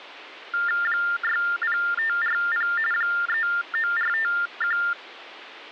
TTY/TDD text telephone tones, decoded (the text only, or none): 60540 39451